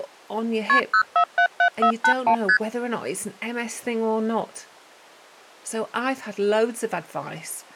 Multi-frequency trunk signalling (R1, as on North American trunks), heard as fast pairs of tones, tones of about 80 ms, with speech in English. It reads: KP 0477481 ST